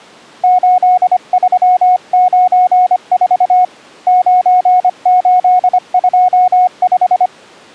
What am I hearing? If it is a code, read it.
Morse code, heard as a keyed tone, hand-sent with a paddle, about 25 wpm, 730 Hz. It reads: 8394 9825